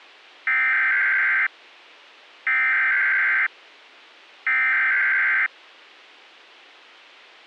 Emergency Alert System (SAME) tones (header bursts), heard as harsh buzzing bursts, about 520.83 baud.